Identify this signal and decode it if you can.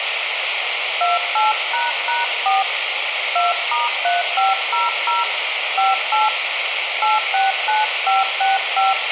DTMF, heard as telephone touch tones, dialled by hand, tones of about 170 ms, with radio hiss and a squelch burst at the end. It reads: 28##4 2*3500 58 869565